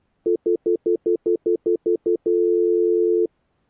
Telephone call progress tone (North American plan), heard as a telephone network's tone, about 350, 440 Hz, 0.1 s on and 0.1 s off. Stutter dial tone.